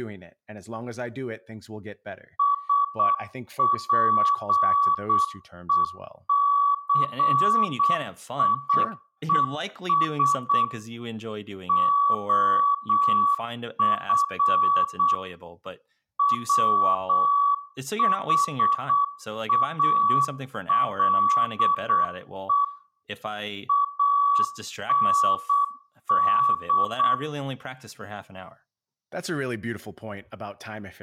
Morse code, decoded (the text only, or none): SPECIES OF WHALE AND